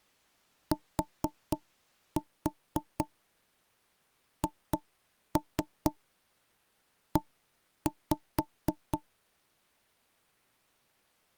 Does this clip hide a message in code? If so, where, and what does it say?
Yes: tap code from 0.7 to 9.0 s, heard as knocks on wood, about 4 knocks a second. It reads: THE